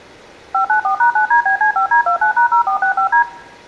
DTMF, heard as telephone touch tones, dialled by machine, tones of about 100 ms, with room echo. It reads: 594#9DBC5D29#0465D